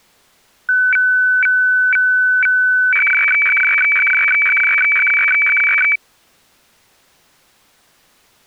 Weather fax (radiofax), 120 lines a minute, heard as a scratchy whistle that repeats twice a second.